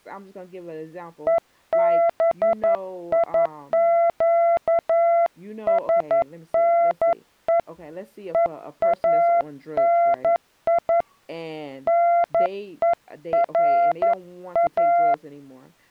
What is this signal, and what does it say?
Morse code (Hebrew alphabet), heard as a keyed tone, hand-sent with a paddle, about 11 wpm, 680 Hz, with speech in English. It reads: וביקשנו ואני נורא